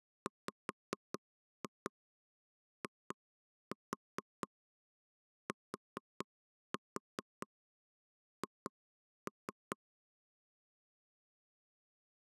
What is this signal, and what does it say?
Tap code, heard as knocks on wood, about 4 knocks a second. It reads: WITH